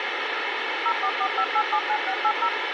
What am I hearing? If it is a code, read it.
DTMF, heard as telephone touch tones, dialled by machine, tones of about 70 ms, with radio hiss. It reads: 0445879680